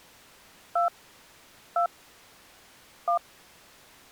DTMF, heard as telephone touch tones, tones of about 100 ms. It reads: 2 2 1